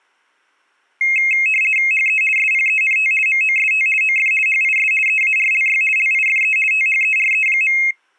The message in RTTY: HE SPENT MOST OF HIS EARLY LIFE THERE.

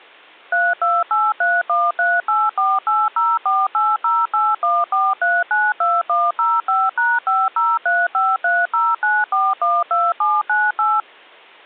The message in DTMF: 3283138480480814392105#5035309412798

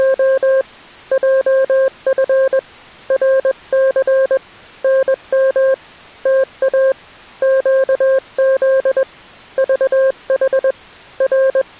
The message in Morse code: … JF RC NM TA QZ VH …

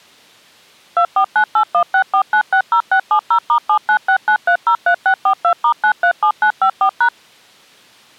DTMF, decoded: 2498164960670*7969303642*937954#

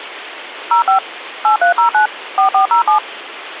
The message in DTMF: 05 8309 4407

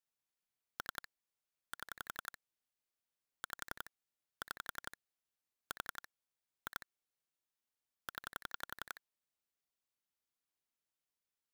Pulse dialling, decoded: 3 7 5 6 4 2 0

